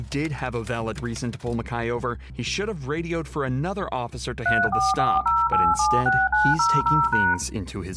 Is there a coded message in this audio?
Yes: DTMF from 4.5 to 7.3 s, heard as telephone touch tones, dialled by machine, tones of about 220 ms, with room echo. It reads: 3440876900#